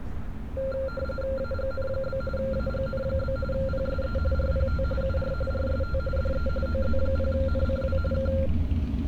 RTTY (45.45 baud, 850 Hz shift), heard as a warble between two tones, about 960 Hz centre, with street noise. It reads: AGN? AGN? PSE RPT UR RST DE OZ0NCW K